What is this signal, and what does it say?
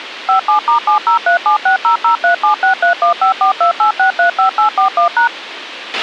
DTMF, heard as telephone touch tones, dialled by machine, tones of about 110 ms, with radio hiss and a squelch burst at the end. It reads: 57*7037600376315428635841#